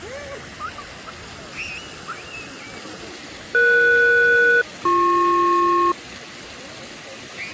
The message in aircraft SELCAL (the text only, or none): ES-BP